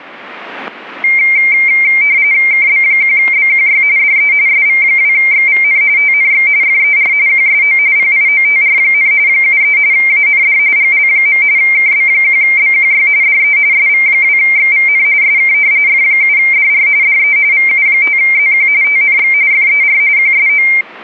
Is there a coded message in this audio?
Yes: RTTY (45.45 baud, 170 Hz shift) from 1.0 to 20.8 s, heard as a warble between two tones, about 2200 Hz centre, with static crashes. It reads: KB1BQY DE SV2XVN TNX FER QSO PIOTR, 73 AND GL. KB1BQY DE SV2XVN SK F7DR DE VU5ZQ TNX FER QSO